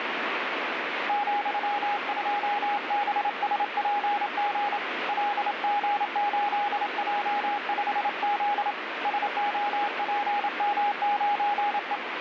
Morse code, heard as a keyed tone, hand-sent with a straight key, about 28 wpm, 820 Hz, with radio static. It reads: ,2BSPG LG8J5Z SOPM9E